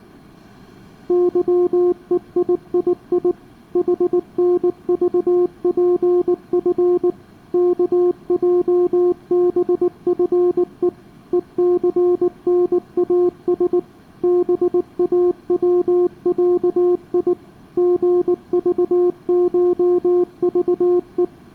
Morse code (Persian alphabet), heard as a keyed tone, machine-sent, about 19 wpm, 360 Hz, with room echo. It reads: ظهییی حنذپف کجبفه هثناس باوصی ژذشذه